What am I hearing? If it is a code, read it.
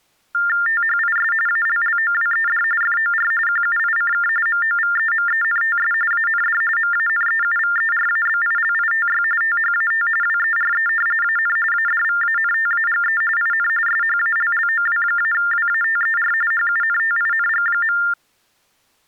TTY/TDD text telephone tones (45.45 baud Baudot), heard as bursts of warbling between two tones, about 400 Hz shift, 1600 Hz centre. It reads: THIS ALLOWED FOR QUICK MOVEMENTS AND MANEUVERABILITY THAT WERE AN ADVANTAGE IN SHALLOW-WATER HUNTING.